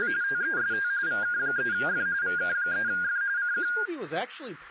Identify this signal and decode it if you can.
RTTY (45.45 baud, 170 Hz shift), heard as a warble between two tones, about 1500 Hz centre, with radio static and speech in English. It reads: … TEST VK3F VK3F CQ